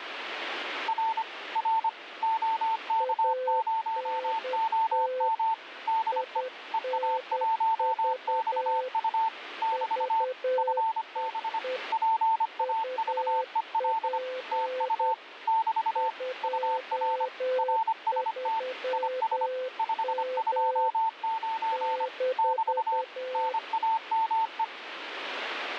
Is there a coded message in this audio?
Yes: Morse code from 0.8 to 24.7 s, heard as two keyed tones, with radio static. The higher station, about 25 wpm, 900 Hz: R R OK0OM DE EA1XU <BT> FB PAVEL TU <BT> UR RST IS 529 <BT> NAME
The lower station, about 10 wpm, 510 Hz: ANT INV VEE UP 23M -